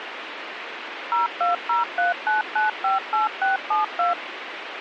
DTMF, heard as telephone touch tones, dialled by machine, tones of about 140 ms, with radio hiss. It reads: 02039958672